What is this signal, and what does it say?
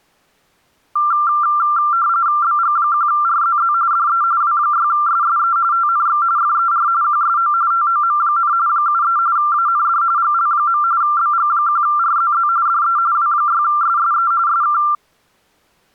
RTTY (45.45 baud, 170 Hz shift), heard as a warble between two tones, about 1280 Hz centre. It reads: BG1RZZ DE W6SSE TNX FER QSO TOM, 73 AND GL. BG1RZZ DE W6SSE SK